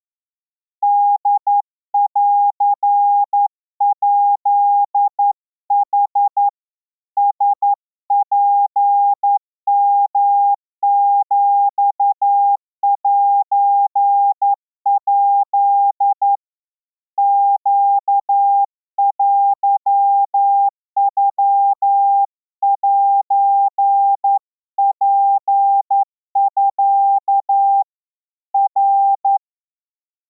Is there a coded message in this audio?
Yes: Morse code (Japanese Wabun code) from 0.8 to 29.4 s, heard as a keyed tone, hand-sent with a straight key, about 11 wpm, 800 Hz. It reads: ホンヱヌ ラツヨヒセヱ ネテノセツミ ナ